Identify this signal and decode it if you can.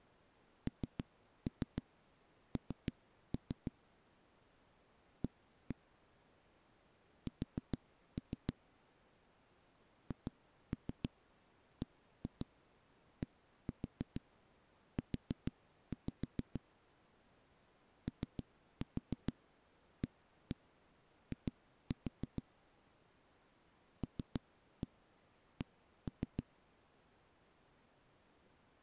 Tap code, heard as knocks on a wall, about 6 knocks a second. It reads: NN A S HBDU OAI LC